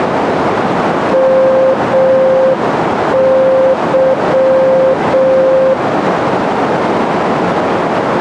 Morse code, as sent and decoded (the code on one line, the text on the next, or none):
-- -.--
MY